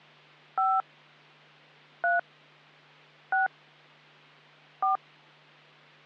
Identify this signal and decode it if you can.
DTMF, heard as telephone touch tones, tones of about 160 ms, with hum. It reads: 5 3 6 4